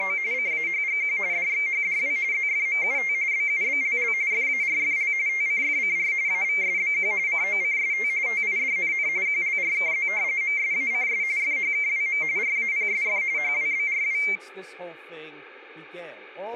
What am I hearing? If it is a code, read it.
RTTY (45.45 baud, 170 Hz shift), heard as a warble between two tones, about 2200 Hz centre, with radio static and speech in English. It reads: … CAHGQ DXHDW ZFMUT BUBLL FARFL TCFCR AVSBQ COCST TIDNN QLRKZ MSACS FHKWM RAPSF HWBRW